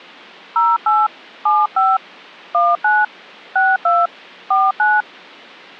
DTMF, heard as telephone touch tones, dialled by hand, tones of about 210 ms. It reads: 08 75 19 62 49